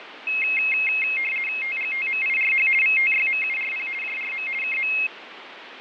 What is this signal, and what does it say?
RTTY (50 baud, 450 Hz shift), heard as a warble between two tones, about 2350 Hz centre, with radio static and fading. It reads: TGTMIRH VTYMURP JRM KM